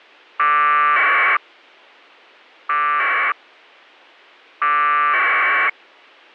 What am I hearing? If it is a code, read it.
Packet radio (AX.25, as in APRS), 1200 baud, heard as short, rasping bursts.